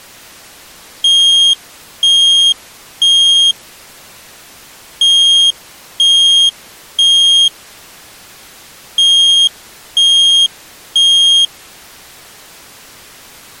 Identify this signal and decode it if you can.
Alarm pattern, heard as an alarm's beeps, played three times, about 3250 Hz. Temporal three. Smoke or fire, evacuate.